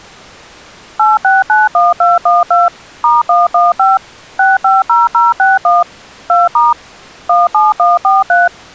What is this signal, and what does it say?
DTMF, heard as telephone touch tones, dialled by machine, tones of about 180 ms. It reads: 8691212 *115 650061 2* 17143